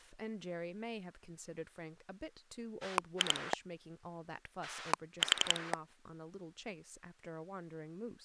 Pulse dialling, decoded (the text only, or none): 2 4